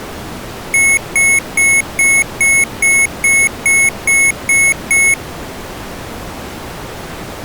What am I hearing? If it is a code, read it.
Beep code, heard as beeps from a small speaker, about 2200 Hz. 11 short. In AMI BIOS tables: cache memory error.